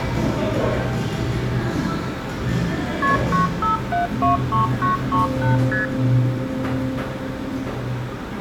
Multi-frequency trunk signalling (R1, as on North American trunks), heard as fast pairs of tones, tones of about 140 ms, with room echo and the noise of a cafe. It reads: KP 95723938 ST